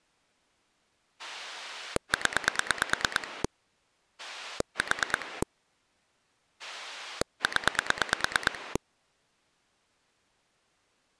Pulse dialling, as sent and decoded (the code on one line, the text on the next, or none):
10 / 4 / 10
0 4 0